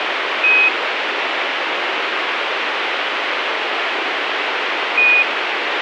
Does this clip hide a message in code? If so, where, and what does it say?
Yes: Quindar tones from 0.4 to 5.2 s, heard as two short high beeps, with radio hiss.